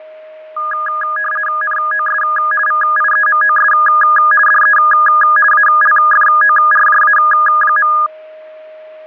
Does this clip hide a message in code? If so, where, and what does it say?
Yes: RTTY (50 baud, 450 Hz shift) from 0.6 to 8.1 s, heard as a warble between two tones, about 1440 Hz centre, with fading and a steady whistle near 620 Hz. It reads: NOS VIEMOS DE ALFORJA.